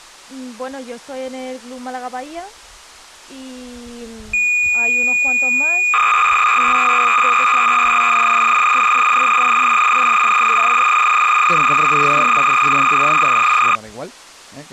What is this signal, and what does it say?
Cassette data (Kansas City type), 300 baud, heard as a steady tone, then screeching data.